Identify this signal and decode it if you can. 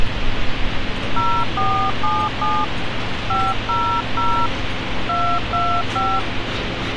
DTMF, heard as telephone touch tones, dialled by hand, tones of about 280 ms, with radio hiss and street noise. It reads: 0477 500 225